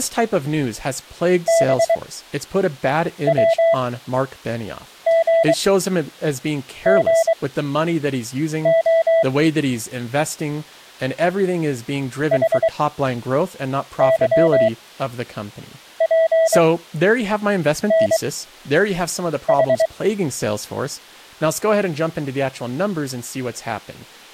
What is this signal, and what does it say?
Morse code, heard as a keyed tone, machine-sent, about 23 wpm, spaced as for 6 wpm, 660 Hz, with speech in English. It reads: BWGGO HYPNH